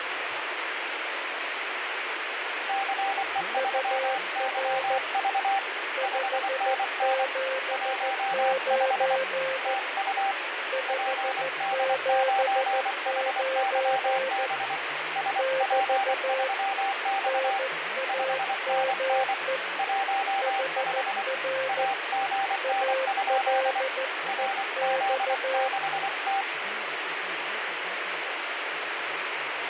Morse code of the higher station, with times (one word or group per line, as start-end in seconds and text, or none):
2.7-5.6 CE3YV
6.0-7.2 5NN
7.7-9.2 15
9.7-10.3 TU
10.9-14.8 PD9HYB
15.2-17.6 SP3X
18.1-19.3 5NN
19.8-21.2 15
21.7-23.8 AGN?
24.3-26.4 RZ6T